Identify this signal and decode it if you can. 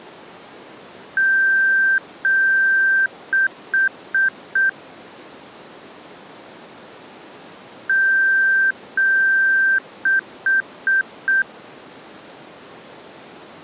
Beep code, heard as beeps from a small speaker, played twice, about 1550 Hz. 2 long, 4 short.